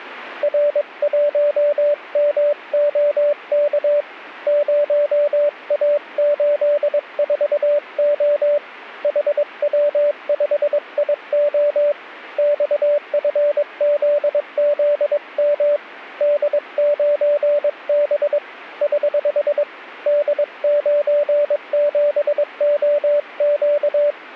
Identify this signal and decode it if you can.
Morse code, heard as a keyed tone, hand-sent with a paddle, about 22 wpm, 580 Hz. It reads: R1MOK 0A84O HW5IO XFZZM D9B <HH> D97OQ